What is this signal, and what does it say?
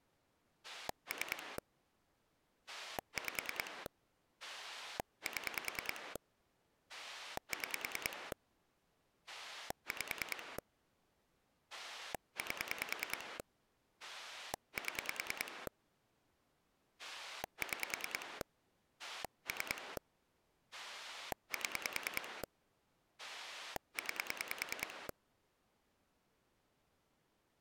Pulse dialling, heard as a rotary dial, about 10 pulses a second. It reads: 3 5 7 6 5 8 7 6 3 7 9